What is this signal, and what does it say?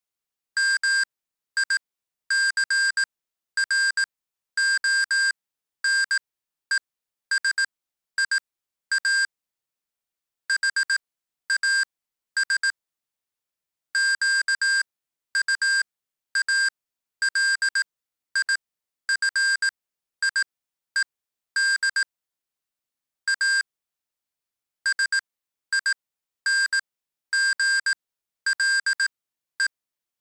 Morse code, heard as electronic beeps, machine-sent, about 18 wpm, spaced as for 11 wpm, 1600 Hz. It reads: MICRONESIA HAS QUALIFIED A SINGLE